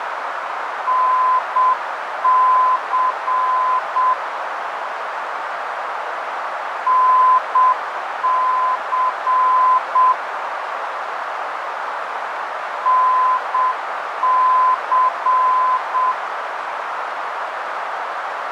Morse code, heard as a keyed tone, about 7 wpm, 1020 Hz, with radio static and a narrow filter. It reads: NC NC NC